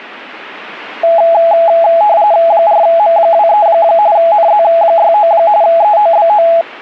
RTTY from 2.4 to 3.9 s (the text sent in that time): 4M23